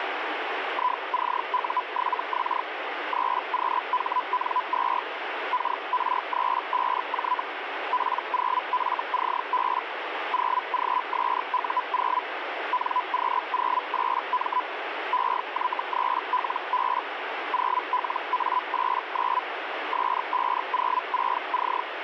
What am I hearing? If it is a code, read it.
Hellschreiber (Feld-Hell, 122.5 baud), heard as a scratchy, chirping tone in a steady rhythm, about 1000 Hz, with radio static. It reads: ICU7X 3QHN2 KR35J P0FCB 0GSU0 NQ08M EY3LB 0LA89 S506C